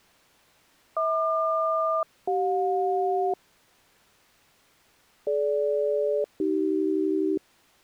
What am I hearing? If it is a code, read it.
Aircraft SELCAL, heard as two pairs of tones. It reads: HQ-CJ DG-AC